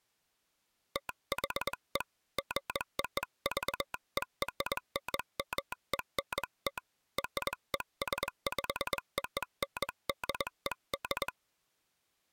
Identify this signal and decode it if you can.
Morse code (American railroad code), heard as a telegraph sounder, hand-sent with a straight key. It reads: THE GOVERNMENT RESPONDED